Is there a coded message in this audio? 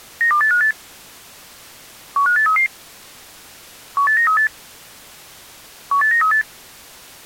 Yes: five-tone selective call (CCIR) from 0.2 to 6.4 s, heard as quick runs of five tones, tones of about 100 ms. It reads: 92858 15833 18938 18938